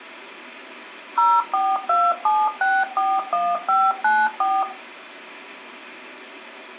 DTMF, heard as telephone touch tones, dialled by machine, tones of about 230 ms. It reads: 0427641594